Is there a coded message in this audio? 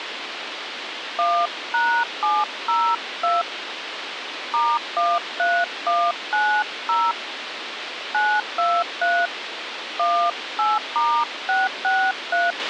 Yes: DTMF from 1.2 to 12.5 s, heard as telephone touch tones, dialled by hand, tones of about 240 ms, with radio hiss and a squelch burst at the end. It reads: 1#702 *13190 923 18*663